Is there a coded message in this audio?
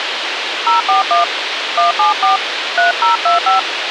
Yes: DTMF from 0.7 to 3.6 s, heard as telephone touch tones, dialled by hand, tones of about 140 ms, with radio hiss and a squelch burst at the end. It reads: 041 174 3025